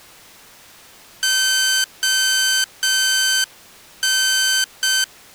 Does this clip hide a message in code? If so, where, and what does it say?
Yes: Morse code (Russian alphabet) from 1.2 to 5.1 s, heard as electronic beeps, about 6 wpm, 1550 Hz. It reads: ОН